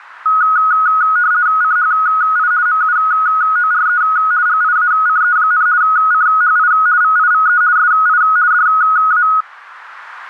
RTTY (50 baud, 170 Hz shift), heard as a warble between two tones, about 1360 Hz centre. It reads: CHI MUORE GIACE, CHI VIVE SI DA